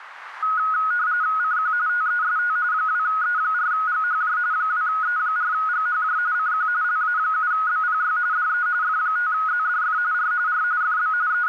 RTTY (45.45 baud, 170 Hz shift), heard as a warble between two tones, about 1360 Hz centre, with radio static. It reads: CQ TEST 2E4GHJ 2E4GHJ CQ LA7BPY DE F5ZDF R R FB …